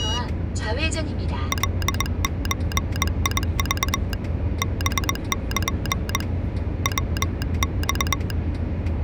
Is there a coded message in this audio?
Yes: Morse code (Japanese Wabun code) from 1.5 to 8.4 s, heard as a telegraph sounder, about 21 wpm, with the noise inside a car. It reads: カゾク ハル ヤマ